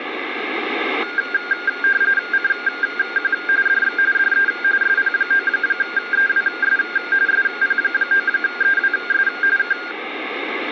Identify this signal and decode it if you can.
RTTY (45.45 baud, 170 Hz shift), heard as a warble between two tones, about 1500 Hz centre, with radio static. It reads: CQ DX DE SP9EWS SP9EWS K